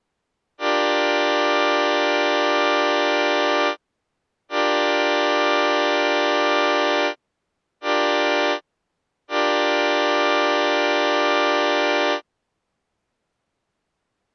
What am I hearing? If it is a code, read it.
Train horn signal, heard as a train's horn. 2 long, 1 short, 1 long. On North American railways: approaching a public crossing.